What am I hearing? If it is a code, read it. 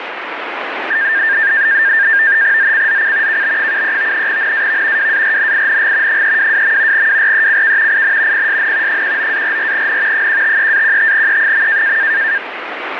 NAVTEX (SITOR-B), 100 baud, 170 Hz shift, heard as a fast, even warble, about 1700 Hz centre, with radio static. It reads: ZCZC KB73 NAV WARNING 322. WRECK IN PSN 19-44N 153-15E.